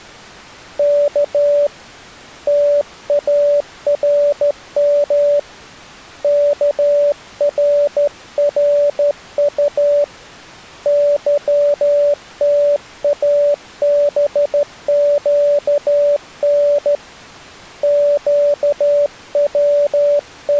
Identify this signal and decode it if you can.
Morse code, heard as a keyed tone, hand-sent with a straight key, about 13 wpm, 580 Hz. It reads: K TARM KRRU YTABQN …